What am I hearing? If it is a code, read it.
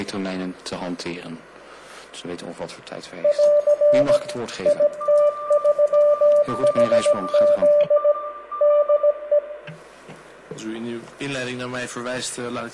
Morse code, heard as two keyed tones, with room echo. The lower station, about 17 wpm, 590 Hz: <AR> IT3HZ DE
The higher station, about 13 wpm, 1190 Hz: RIG IS